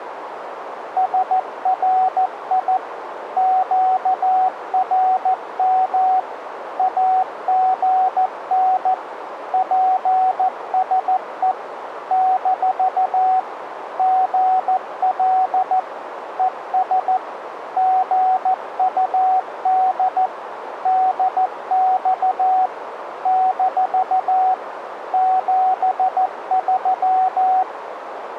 Morse code, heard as a keyed tone, machine-sent, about 14 wpm, 750 Hz, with radio static and a narrow filter. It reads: SRI QRM AGN PSE - GL ES GUD DX - 73